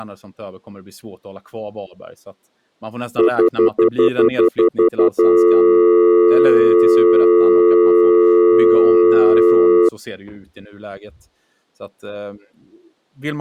Telephone call progress tone (North American plan), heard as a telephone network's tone, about 350, 440 Hz, 0.1 s on and 0.1 s off, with speech in Swedish. Stutter dial tone.